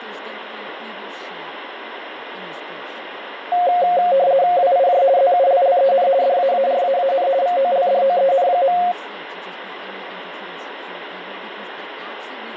RTTY (50 baud, 170 Hz shift), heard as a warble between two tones, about 630 Hz centre, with radio static and speech in English. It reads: WIJ ZULLEN DAARAAN VOLDOEN.